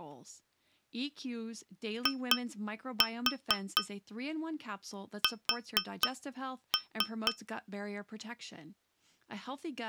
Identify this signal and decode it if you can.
Tap code, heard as taps on glass, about 4 knocks a second, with speech in English. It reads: IS